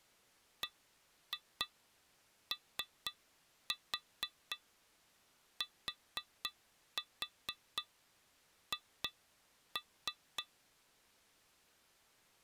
Tap code, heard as taps on glass, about 4 knocks a second. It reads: BOTH